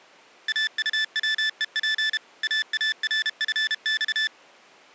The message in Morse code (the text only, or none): AUWEP AARFX